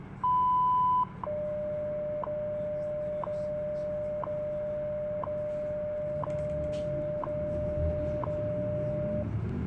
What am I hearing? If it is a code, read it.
Radio time signal (WWV, Colorado), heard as ticks, one a second, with radio static and the noise inside a bus.